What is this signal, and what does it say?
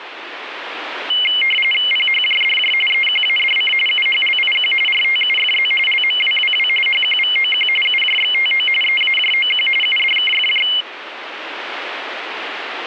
RTTY (45.45 baud, 850 Hz shift), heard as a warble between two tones, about 2550 Hz centre, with radio static. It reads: PHJDJ EQADC UHLIQ RTUFZ LMWWW HQVOQ UJXTO EAJOQ UDKFJ